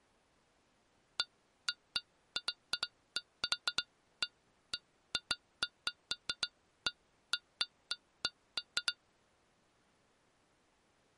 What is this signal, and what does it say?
Irregular taps on glass. There is no code.